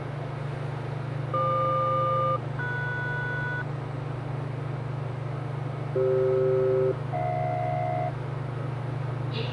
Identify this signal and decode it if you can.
Aircraft SELCAL, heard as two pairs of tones, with the noise inside a lift. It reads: FQ-MS CF-HJ